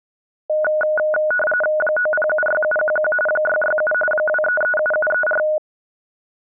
RTTY (45.45 baud, 850 Hz shift), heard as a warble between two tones, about 1040 Hz centre. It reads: 9076711 667 2337734